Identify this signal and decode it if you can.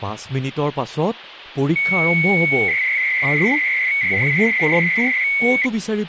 300-baud modem data (Bell 103 tones), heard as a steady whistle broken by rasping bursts, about 300 baud, 200 Hz shift, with phone line noise and speech in Assamese.